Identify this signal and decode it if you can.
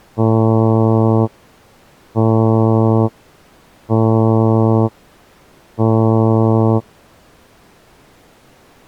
Ship horn signal, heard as a ship's horn, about 110 Hz. 4 short. At sea: a pilot vessel's identity signal in fog.